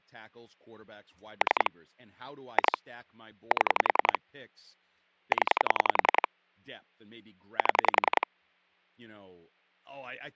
Pulse dialling, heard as clicks on a phone line, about 10 pulses a second, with speech in English. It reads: 3 2 7 0 7